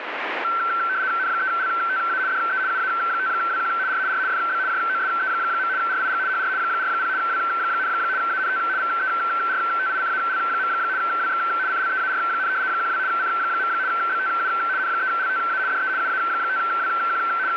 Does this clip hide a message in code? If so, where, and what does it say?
Yes: RTTY (75 baud, 170 Hz shift) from 0.4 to 17.6 s, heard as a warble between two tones, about 1440 Hz centre, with radio static. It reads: N3LTA DE UA5WQ R R FB JOSE. RIG HR 40 W, ANT VERTICAL. WX CLEAR, 12 C. BTU N3LTA DE UA5WQ …